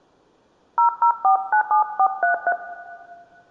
DTMF, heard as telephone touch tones, dialled by hand, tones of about 90 ms, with room echo. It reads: 00497433